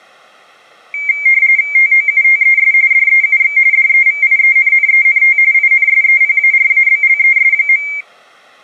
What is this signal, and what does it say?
RTTY (45.45 baud, 170 Hz shift), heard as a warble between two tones, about 2200 Hz centre. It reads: TOUTES DEUX DEVIENNENT INSEPARABLES.